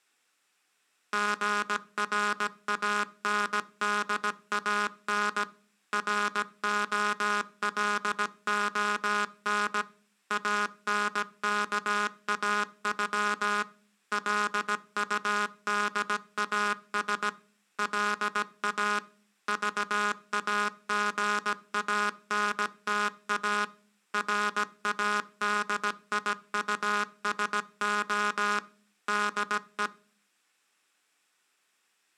Morse code (with Esperanto letters), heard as a buzzer, machine-sent, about 17 wpm. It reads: GRANDAN ROLON ANKAŬ LUDAS LA VAGANTA RADIUSO DE